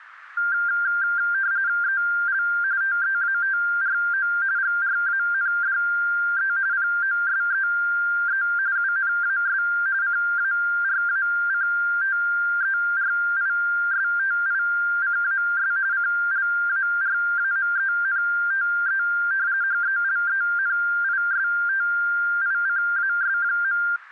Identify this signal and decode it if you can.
RTTY (45.45 baud, 170 Hz shift), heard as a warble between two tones, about 1490 Hz centre. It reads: EL TEATRO GRANDE POSEE UNAS CARACTERISTICAS CLARAMENTE HELENISTICAS.